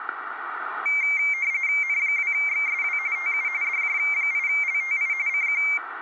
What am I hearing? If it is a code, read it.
RTTY (45.45 baud, 170 Hz shift), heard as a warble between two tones, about 2200 Hz centre. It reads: N2XSW TU DJ8LTI CQ